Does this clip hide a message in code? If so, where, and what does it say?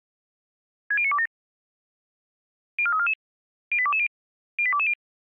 Yes: five-tone selective call (ZVEI) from 0.9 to 4.9 s, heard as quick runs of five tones, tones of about 70 ms. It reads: 60927 04344 08220 08220